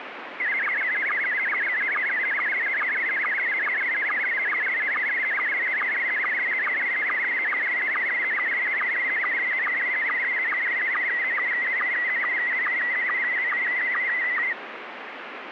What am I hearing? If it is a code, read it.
SSTV (slow-scan television), Scottie S1, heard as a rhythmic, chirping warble, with radio static.